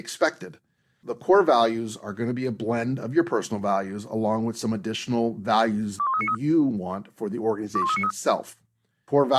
Five-tone selective call (ZVEI), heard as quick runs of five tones, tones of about 70 ms, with speech in English. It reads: 21393 21393